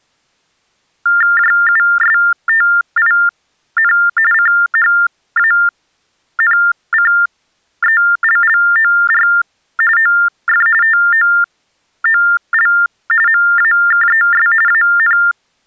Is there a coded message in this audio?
Yes: TTY/TDD text telephone tones (45.45 baud Baudot) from 1.1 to 15.3 s, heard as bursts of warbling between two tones, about 400 Hz shift, 1600 Hz centre. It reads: JUSTIN CHANCELLOR OF TOOL MAKES AN